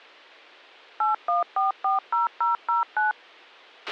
DTMF, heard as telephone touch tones, dialled by machine, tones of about 140 ms, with a squelch burst at the end. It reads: 81440009